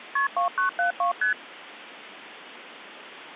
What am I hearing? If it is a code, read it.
Multi-frequency trunk signalling (R1, as on North American trunks), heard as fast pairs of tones, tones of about 120 ms. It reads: KP 2972 ST